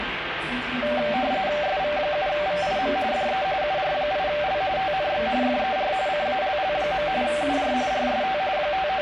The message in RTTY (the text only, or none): SV7VIM DE UR8L TNX FER CALL. UR RST …